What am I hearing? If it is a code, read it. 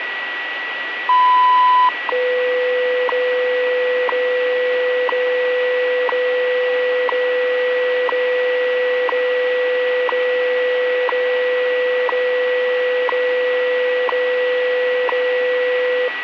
Radio time signal (WWV, Colorado), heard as ticks, one a second, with radio static and a steady whistle near 1940 Hz.